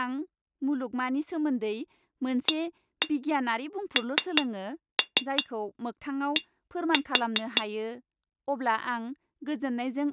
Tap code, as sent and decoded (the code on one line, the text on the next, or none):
1-1 3-3 1-4
AND